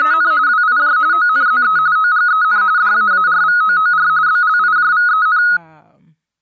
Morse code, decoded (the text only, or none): none